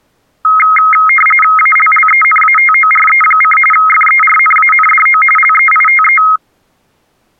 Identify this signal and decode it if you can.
RTTY (45.45 baud, 850 Hz shift), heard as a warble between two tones, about 1700 Hz centre. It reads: ALLENATORE: FERNANDO LEITE